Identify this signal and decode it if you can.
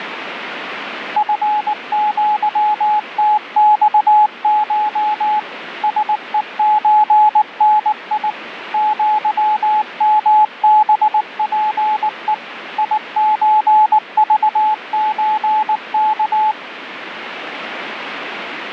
Morse code (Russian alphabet), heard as a keyed tone, machine-sent, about 19 wpm, 850 Hz, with radio static. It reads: ФЪТЬШ СЕЧНИ ЪМБПЕ ИЧЖЧК